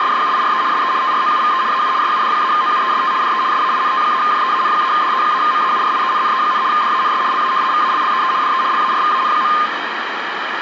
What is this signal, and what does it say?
RTTY (75 baud, 170 Hz shift), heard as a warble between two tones, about 1140 Hz centre, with radio static. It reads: … SE TROUVE AU SUD-OUEST DE SAINT-JEAN-DE-MAURIENNE, DANS LA VALLEE DE LARVAN.